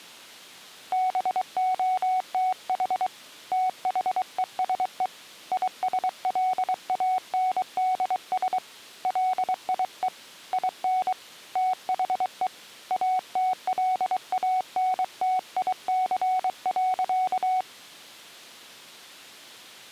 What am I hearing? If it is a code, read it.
Morse code, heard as a keyed tone, hand-sent with a paddle, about 23 wpm, 740 Hz. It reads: BOTH THESE ISLANDS LIE IN THE ATLANTIC.